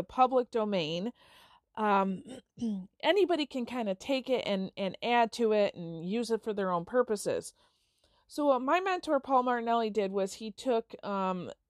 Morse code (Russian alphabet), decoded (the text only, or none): none